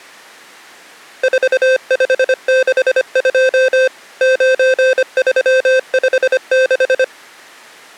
Morse code, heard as electronic beeps, machine-sent, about 25 wpm, 520 Hz. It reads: 4562 9356